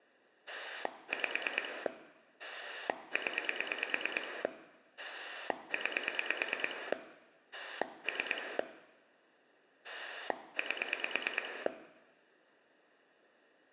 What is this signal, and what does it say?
Pulse dialling, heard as a rotary dial, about 9 pulses a second, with room echo. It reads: 5 0 9 3 8